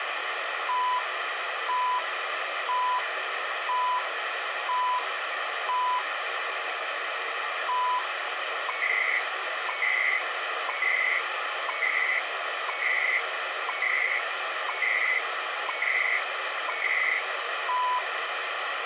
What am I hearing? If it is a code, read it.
Radio time signal (CHU, Canada), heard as beeps and data bursts, one a second, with radio static.